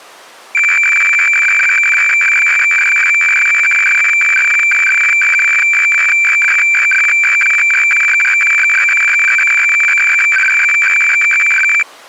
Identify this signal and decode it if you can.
Weather fax (radiofax), 120 lines a minute, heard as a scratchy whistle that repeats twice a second.